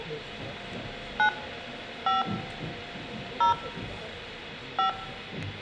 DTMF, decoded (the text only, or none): 9 5 0 5